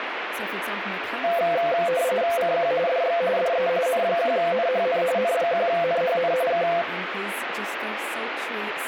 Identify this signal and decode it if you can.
RTTY (45.45 baud, 170 Hz shift), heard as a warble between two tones, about 600 Hz centre, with radio static and speech in English. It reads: CQ DX DE N1NHN N1NHN K